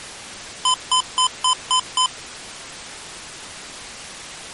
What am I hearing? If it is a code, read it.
Beep code, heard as beeps from a small speaker, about 1020 Hz. 6 short. In AMI BIOS tables: keyboard controller gate A20 failure; in Dell tables: video card failure.